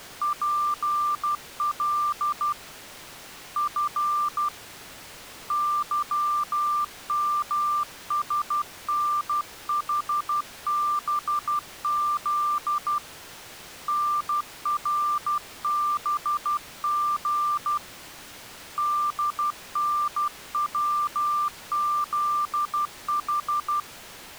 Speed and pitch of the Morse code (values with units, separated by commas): 12 wpm, 1190 Hz